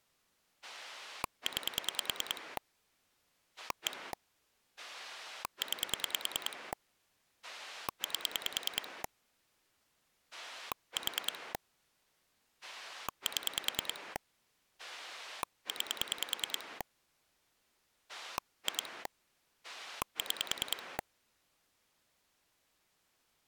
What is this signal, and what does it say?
Pulse dialling, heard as a rotary dial, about 10 pulses a second. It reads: 9 1 9 8 4 7 9 2 6